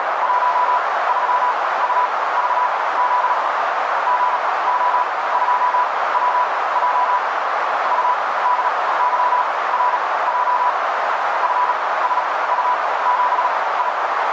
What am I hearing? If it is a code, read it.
Morse code, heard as a keyed tone, machine-sent, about 37 wpm, spaced as for 20 wpm, 990 Hz, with heavy radio static and a narrow filter. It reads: 13UVZ GO2WJ UDYRJ FSU7I